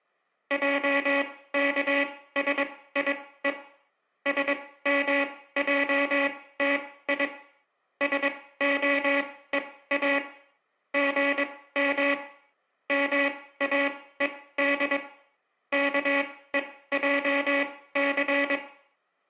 Morse code (Hebrew alphabet), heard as a buzzer, machine-sent, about 22 wpm, spaced as for 16 wpm, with room echo. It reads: עכשיו שמעתי שהוא גם מאוד כועס